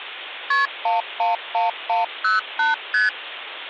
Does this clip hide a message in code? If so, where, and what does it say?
Yes: multi-frequency trunk signalling (R1, as on North American trunks) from 0.5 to 3.1 s, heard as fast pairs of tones, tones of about 150 ms, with phone line noise. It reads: KP 111108 ST